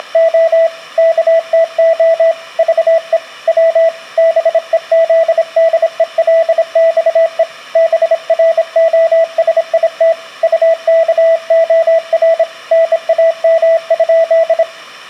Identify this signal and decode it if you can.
Morse code (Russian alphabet), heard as a keyed tone, hand-sent with a bug key, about 26 wpm, 660 Hz, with room echo. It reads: … КТО ЖЕ В БЕЗДЕЛЬЕ БРОСИТ УКОР НАМ?